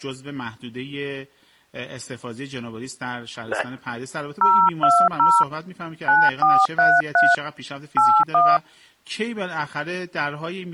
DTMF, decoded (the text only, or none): 020 9433 81